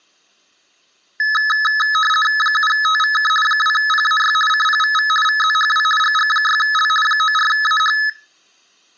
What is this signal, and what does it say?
RTTY (50 baud, 450 Hz shift), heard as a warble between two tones, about 1500 Hz centre. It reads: 7TVK 2PAY CPVV VZHW GG6L 94AH